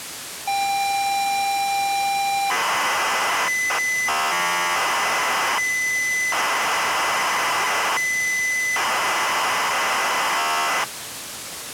ZX Spectrum tape loading, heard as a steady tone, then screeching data, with tape hiss.